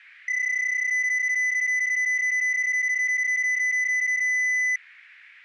PSK31 (31.25 baud), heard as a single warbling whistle, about 2000 Hz.